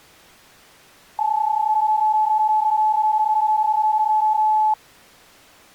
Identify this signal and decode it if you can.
PSK31 (31.25 baud), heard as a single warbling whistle, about 860 Hz.